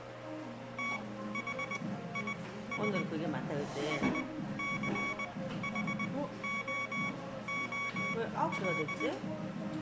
Morse code, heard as electronic beeps, machine-sent, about 20 wpm, spaced as for 14 wpm, 1120 Hz, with room echo and the noise of a cafe. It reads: THIS SCHOOL